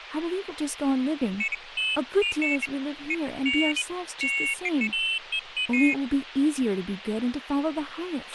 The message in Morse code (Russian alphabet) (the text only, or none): none